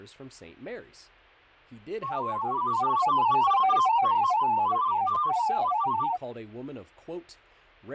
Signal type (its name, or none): multi-tone FSK (Olivia or MFSK type)